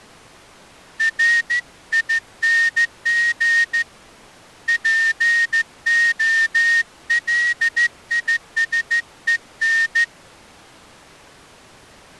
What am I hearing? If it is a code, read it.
Morse code, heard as a whistle, hand-sent with a straight key, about 14 wpm. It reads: RING POLISEN